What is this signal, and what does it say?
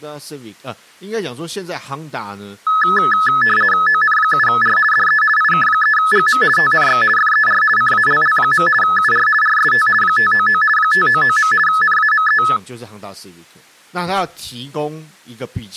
RTTY (50 baud, 450 Hz shift), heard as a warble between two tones, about 1500 Hz centre, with speech in Chinese. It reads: ON7R DE IK3GM TNX FER CALL. UR RST 599 599. NAME